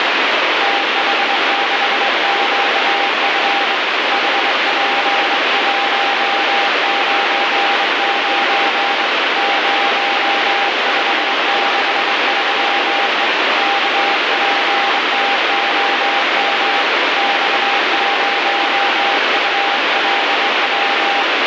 Morse code, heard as a keyed tone, hand-sent with a straight key, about 23 wpm, 800 Hz, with heavy radio static. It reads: TH6QF HP199 0563E KPTOM X0ULW